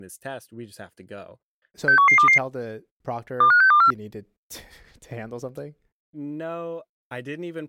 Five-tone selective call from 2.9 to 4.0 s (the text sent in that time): 25624